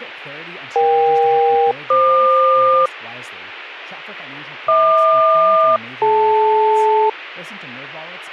Aircraft SELCAL, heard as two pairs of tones, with speech in English. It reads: EK-FQ HQ-DL